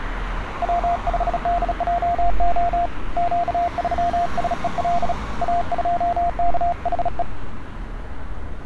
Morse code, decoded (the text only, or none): W5DJO Q3SEL A2KHE